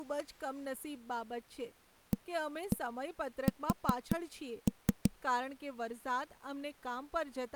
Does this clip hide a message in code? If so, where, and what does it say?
Yes: tap code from 2.1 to 5.1 s, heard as knocks on a wall, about 5 knocks a second, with speech in Gujarati. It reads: AS